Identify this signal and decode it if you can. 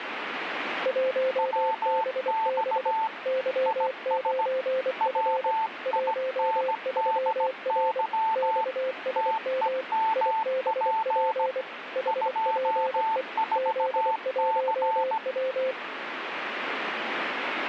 Morse code, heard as two keyed tones, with radio static. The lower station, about 24 wpm, 520 Hz: 1BB Y9F 13R XSM IBP HPE Z1W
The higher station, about 17 wpm, 890 Hz: WX IS WINDY TEMP 24C